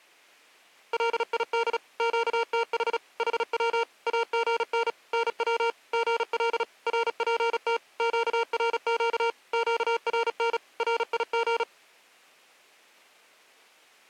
Morse code, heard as electronic beeps, machine-sent, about 36 wpm, 460 Hz. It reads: LID QTH HW AGN NW GL RPT QRQ QRN RIG